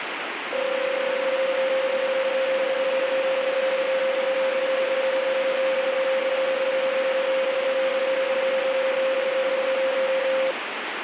PSK31 (31.25 baud), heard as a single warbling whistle, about 530 Hz, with radio static.